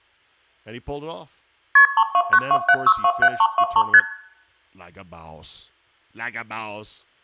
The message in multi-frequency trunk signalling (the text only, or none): KP 32927627323 ST